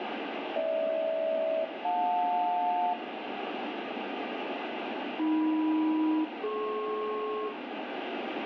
Aircraft SELCAL, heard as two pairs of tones, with radio static and room echo. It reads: GH-JL AM-DP